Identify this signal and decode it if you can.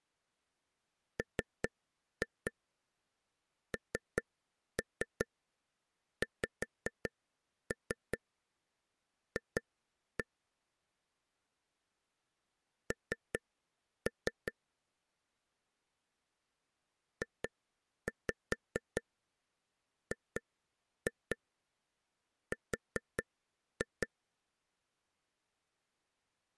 Tap code, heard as taps on a table, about 5 knocks a second. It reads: MNXF N JGR